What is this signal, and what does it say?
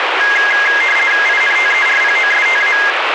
RTTY (50 baud, 450 Hz shift), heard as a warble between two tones, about 1900 Hz centre, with radio static. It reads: INTERPOSTA